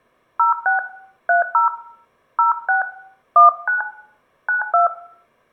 DTMF, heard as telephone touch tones, dialled by hand, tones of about 130 ms, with room echo. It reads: 06 30 06 19 92